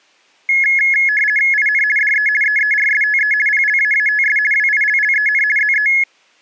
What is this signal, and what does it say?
RTTY (50 baud, 450 Hz shift), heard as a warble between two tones, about 1950 Hz centre. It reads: IN DE EERSTE PLAATS WILLEN ZE